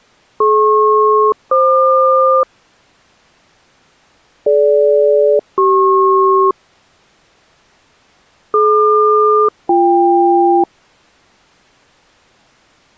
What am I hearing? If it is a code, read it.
Aircraft SELCAL, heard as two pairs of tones. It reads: DP-FQ DG-CP DQ-BK